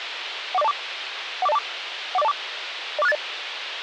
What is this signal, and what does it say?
Five-tone selective call (EIA), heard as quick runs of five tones, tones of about 30 ms, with radio hiss. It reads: 14024 14024 14024 04680